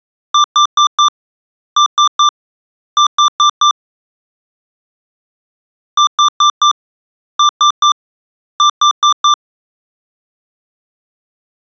Beep code, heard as beeps from a small speaker, played twice, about 1180 Hz. 4-3-4. In Phoenix BIOS tables: time-of-day clock failure.